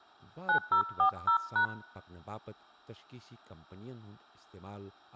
DTMF, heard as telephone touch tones, dialled by hand, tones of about 100 ms, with speech in Kashmiri. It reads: 9040#